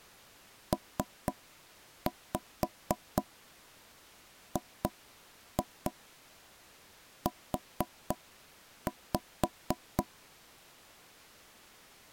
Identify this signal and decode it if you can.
Tap code, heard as knocks on wood, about 4 knocks a second. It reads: PGU